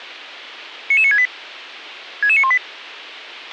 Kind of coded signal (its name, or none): five-tone selective call